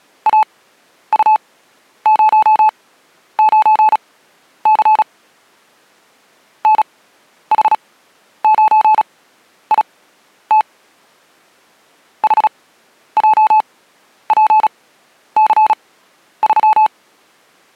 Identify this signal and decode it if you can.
Morse code, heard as a keyed tone, machine-sent, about 36 wpm, spaced as for 11 wpm, 860 Hz. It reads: AU09C NH9IT HJPC3